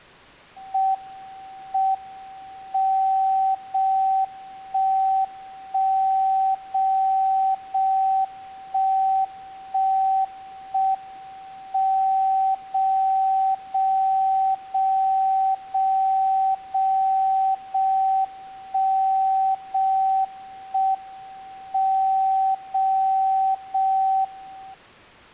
Radio time signal (JJY), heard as a tone whose level steps once a second, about 770 Hz. The time is 05:37 Japan time. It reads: M M 0 1 1 0 0 1 1 1 M 0 0 0 0 0 0 1 0 1 M 0 0 1